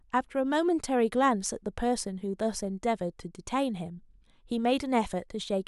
Speech in English. There is no code.